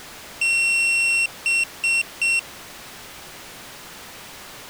Beep code, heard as a piezo beeper, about 2700 Hz. 1 long, 3 short. In Award and IBM BIOS tables: video adapter failure; in AMI BIOS tables: memory failure.